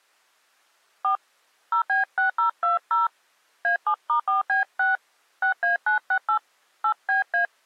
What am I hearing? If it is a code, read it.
DTMF, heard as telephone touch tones, dialled by hand, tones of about 120 ms. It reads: 4 0B6020 A7*4B6 6A968 8BA